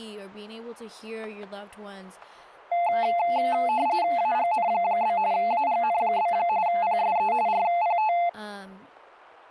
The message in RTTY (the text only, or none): AGN? AGN? PSE RPT